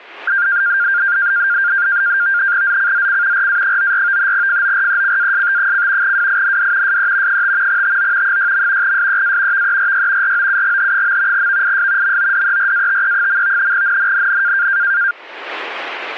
NAVTEX (SITOR-B), 100 baud, 170 Hz shift, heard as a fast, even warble, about 1500 Hz centre, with static crashes. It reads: ZCZC RA94 FORECAST: WIND SE 5 TO 6. SEA VERY ROUGH. VIS MODERATE. NNNN